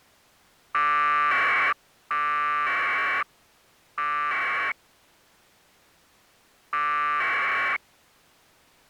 Packet radio (AX.25, as in APRS), 1200 baud, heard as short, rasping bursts.